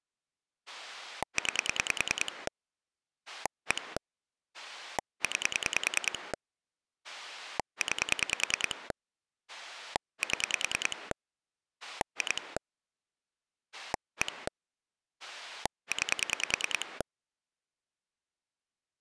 Pulse dialling, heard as a rotary dial, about 10 pulses a second. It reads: 9 1 9 9 7 2 1 9